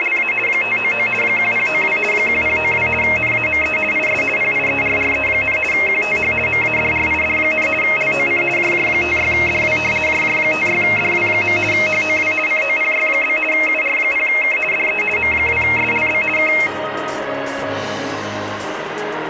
RTTY (50 baud, 450 Hz shift), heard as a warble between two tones, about 2350 Hz centre, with radio static. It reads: … 599 1092 1092 NAME IS PIERRE, QTH MADRID, LOC JJ56DW JJ56DW. HOW COPY? UR0K DE M2SLB K